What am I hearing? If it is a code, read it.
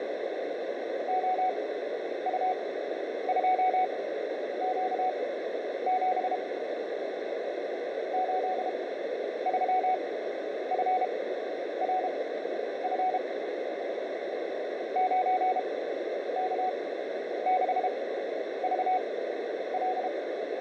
Morse code, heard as a keyed tone, machine-sent, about 32 wpm, spaced as for 10 wpm, 740 Hz, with radio static and a narrow filter. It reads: OU2Q7 83FRF 9K6VL